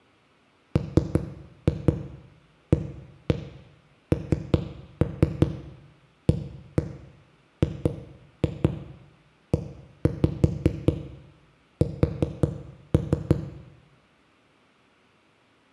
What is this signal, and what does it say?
Tap code, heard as knocks on a wall, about 5 knocks a second, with room echo. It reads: MANAGES